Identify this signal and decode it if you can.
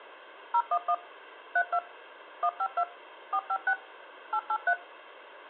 DTMF, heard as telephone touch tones, dialled by machine, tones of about 60 ms. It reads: 011 32 152 456 883